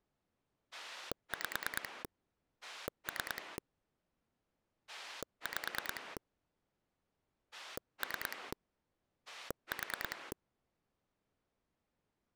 Pulse dialling, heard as a rotary dial, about 9 pulses a second. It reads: 5 3 5 3 4